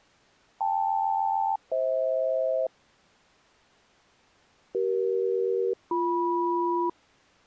Aircraft SELCAL, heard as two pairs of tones. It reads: KL-FH CE-BM